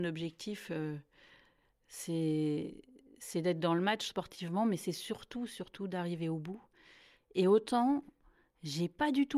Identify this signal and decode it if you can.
Speech in French. There is no code.